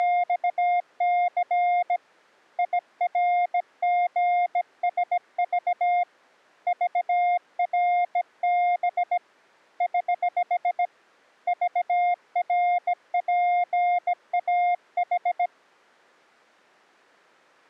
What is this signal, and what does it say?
Morse code, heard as a keyed tone, hand-sent with a bug key, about 17 wpm, 710 Hz. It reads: … IRGSV VRB <HH> VRPAH